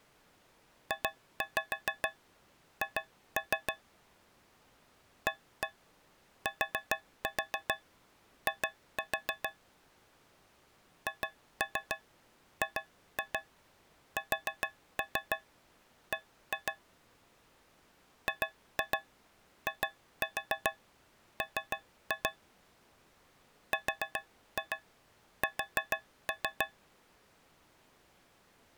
Tap code, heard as taps on a metal pipe, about 6 knocks a second. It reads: JH ATI HGSB GIM RS